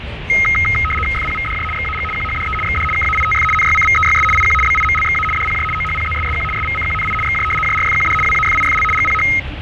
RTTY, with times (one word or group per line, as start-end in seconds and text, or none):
1.1-1.6 FPVDJ
1.7-2.0 XAG
2.1-2.5 QHDE
2.6-2.8 XD
2.9-3.4 KAITF
3.5-4.2 NYCVEYS
4.3-4.5 IQ
4.6-5.2 BIMLXA
5.3-5.6 DPJ
5.7-6.4 OHPZSSQ
6.5-7.1 SVCQNI
7.2-7.4 XJ
7.6-8.1 JRFQD
8.2-8.8 WAFIFL
8.9-9.2 GPH